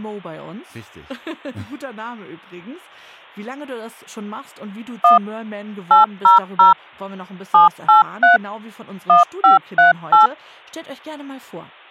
DTMF, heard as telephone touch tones, dialled by machine, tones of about 140 ms. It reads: 1 800 783 1538